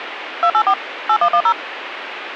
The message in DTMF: 284 8110

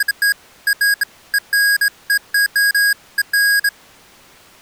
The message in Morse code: none

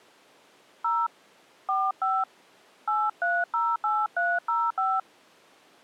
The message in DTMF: 0 45 8308305

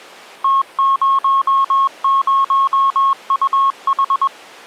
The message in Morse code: T00UH

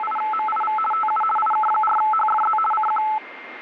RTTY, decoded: … TU IK4HFZ CQ

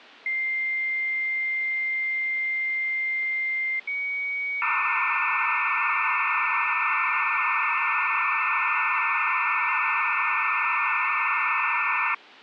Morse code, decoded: none

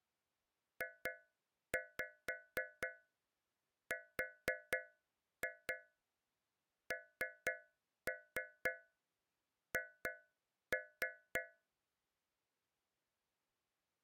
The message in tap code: JRNH

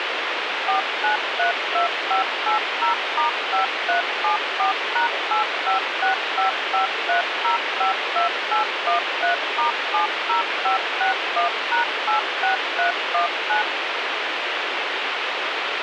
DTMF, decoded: 4932580*5374#856553052813*70561#86319

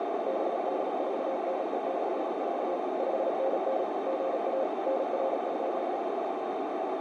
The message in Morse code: BD4NE/4 5NN GA NR?

